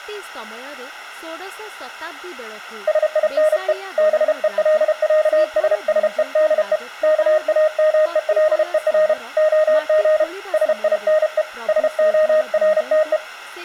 Morse code (with Danish letters), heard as a keyed tone, hand-sent with a paddle, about 32 wpm, 620 Hz, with speech in Odia. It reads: SINE BELÆSSEDE KAMELER OG SINE SORTE